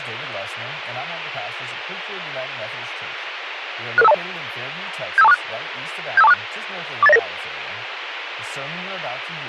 Five-tone selective call (EIA), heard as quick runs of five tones, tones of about 30 ms, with radio hiss and speech in English. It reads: 66520 75246 75246 48099